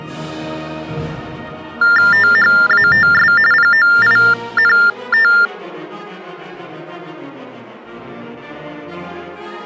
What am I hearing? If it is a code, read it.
TTY/TDD text telephone tones (45.45 baud Baudot), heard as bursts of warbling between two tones, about 400 Hz shift, 1600 Hz centre. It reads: THATS POINT